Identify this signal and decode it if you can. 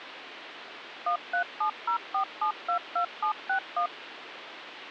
DTMF, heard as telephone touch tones, dialled by machine, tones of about 100 ms, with phone line noise. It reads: 13704722761